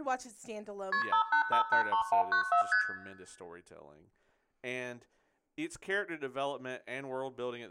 Multi-frequency trunk signalling (R1, as on North American trunks), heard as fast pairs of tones, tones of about 100 ms, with room echo and speech in English. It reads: KP 58583194 ST